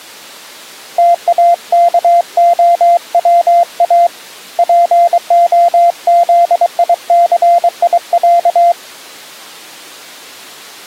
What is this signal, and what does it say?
Morse code (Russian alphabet), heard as a keyed tone, hand-sent with a paddle, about 23 wpm, 690 Hz. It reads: ТАКОВА ПОЗИЦИЯ